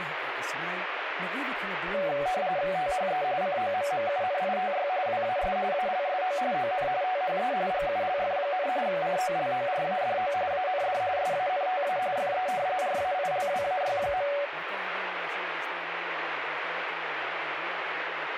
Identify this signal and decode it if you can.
RTTY (45.45 baud, 170 Hz shift), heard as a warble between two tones, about 660 Hz centre, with radio static. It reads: THE COMMUNITY WAS ALSO ON THE GULF, COLORADO AND SANTA FE RAILWAY.